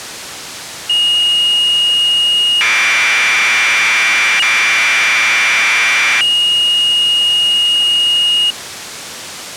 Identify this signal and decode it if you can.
Commodore tape loading (standard loader), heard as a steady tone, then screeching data.